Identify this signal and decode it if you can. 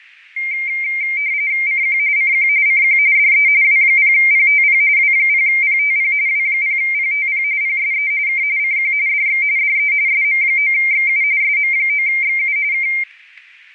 RTTY (45.45 baud, 170 Hz shift), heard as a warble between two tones, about 2200 Hz centre, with fading and static crashes. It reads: CQ CQ CQ DE W0PTP W0PTP W0PTP PSE K CQ DX DE SM9XU SM9XU K